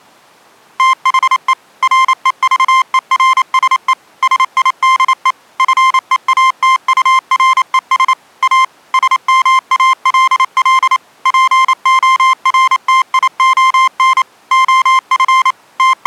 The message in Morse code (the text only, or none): THE REVERSE SIDE FEATURES A SMALL PORTION OF …